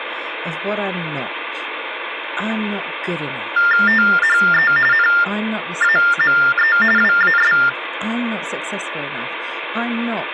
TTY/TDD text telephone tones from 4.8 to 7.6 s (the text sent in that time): NAME WAS